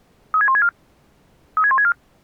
Five-tone selective call (ZVEI), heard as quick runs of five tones, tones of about 70 ms. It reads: 36164 36164